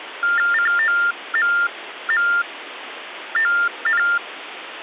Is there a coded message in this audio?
Yes: TTY/TDD text telephone tones (45.45 baud Baudot) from 0.2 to 4.2 s, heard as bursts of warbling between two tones, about 400 Hz shift, 1600 Hz centre, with phone line noise. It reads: COMMON